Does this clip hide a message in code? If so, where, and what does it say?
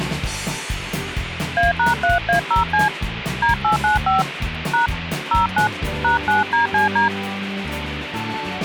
Yes: DTMF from 1.6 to 7.1 s, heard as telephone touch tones, dialled by hand, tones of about 140 ms, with phone line noise. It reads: A#3A0C D895 # 09 #9DCD